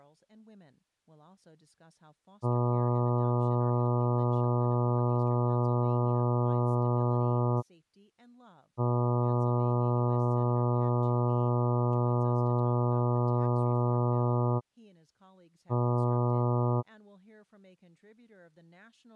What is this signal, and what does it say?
Ship horn signal, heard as a ship's horn, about 120 Hz, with speech in English. 2 long, 1 short. At sea: I intend to overtake on your starboard side.